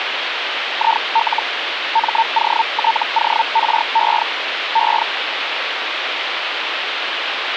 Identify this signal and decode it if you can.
Hellschreiber (Feld-Hell, 122.5 baud), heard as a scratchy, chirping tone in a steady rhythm, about 900 Hz, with radio static. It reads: IL MOTORE E